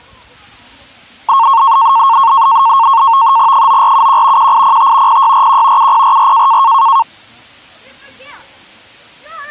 NAVTEX (SITOR-B), 100 baud, 170 Hz shift, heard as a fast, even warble, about 1000 Hz centre, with the noise of a residential street. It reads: 9471 1805 0641 7044